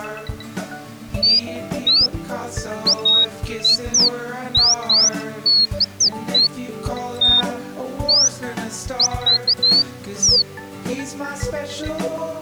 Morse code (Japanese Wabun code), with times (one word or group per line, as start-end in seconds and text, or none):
none